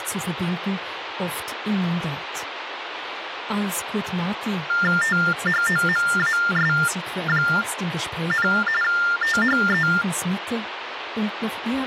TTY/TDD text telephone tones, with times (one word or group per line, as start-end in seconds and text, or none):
5.0-8.5 THOMAS,
8.8-9.9 THE